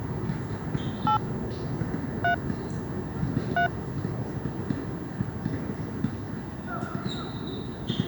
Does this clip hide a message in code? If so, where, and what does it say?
Yes: DTMF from 1.1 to 3.7 s, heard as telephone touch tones, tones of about 100 ms, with the noise of a park. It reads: 8 3 3